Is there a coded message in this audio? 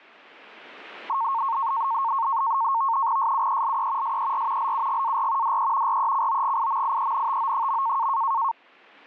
Yes: NAVTEX (SITOR-B), 100 baud, 170 Hz shift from 1.1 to 8.5 s, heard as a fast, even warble, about 1000 Hz centre. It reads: SUELE SER LUGAR DE RECOGIMIENTO.